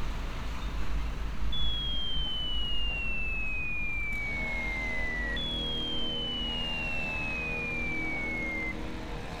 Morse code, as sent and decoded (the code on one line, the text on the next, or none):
none